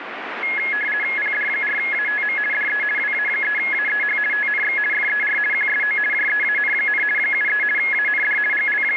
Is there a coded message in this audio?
Yes: RTTY (50 baud, 450 Hz shift) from 0.4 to 9.0 s, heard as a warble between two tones, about 1900 Hz centre, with radio static. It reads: PD4ATM DE WA3AEH TNX FER QSO JEAN, 73 AND …